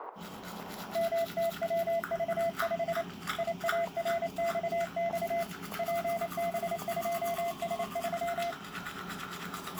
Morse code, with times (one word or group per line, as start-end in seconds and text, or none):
1.0-3.0 MTWV5
3.4-5.4 IARXX
5.8-8.5 PB2S3